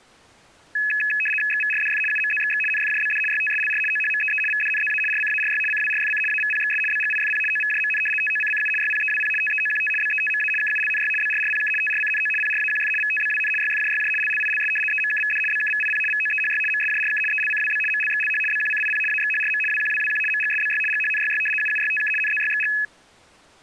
RTTY (75 baud, 850 Hz shift), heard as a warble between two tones, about 2150 Hz centre. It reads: XVRDF UMZXX NFJBD YTSLR OHMEE VDNZA RCARY CWRFC AVPXS BGIFP OVJMN TOCCU YPEWP TEOQT BETMA KULNY BRRPK TRCNO PRAQF VTBWN YFJYJ LLILS EMKVD BKVIP VOEHY MSJRK ELCWB MLXLH BQCIP AXHRM WQWWQ MGSBY GHNYY UUYTK NZYXG